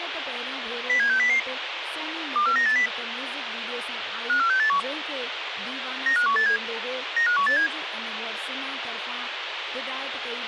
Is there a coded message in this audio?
Yes: five-tone selective call (CCIR) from 0.9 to 7.7 s, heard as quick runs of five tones, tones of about 100 ms, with radio hiss and speech in Sindhi. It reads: 07600 24980 54681 95187 95187